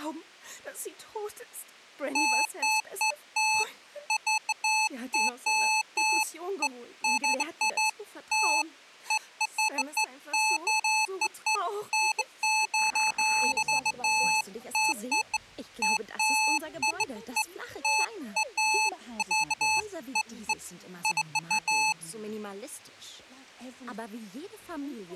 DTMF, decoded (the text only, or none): none